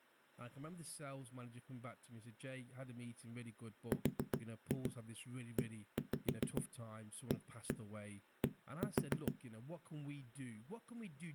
Tap code, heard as knocks on a wall, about 7 knocks a second, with speech in English. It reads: READ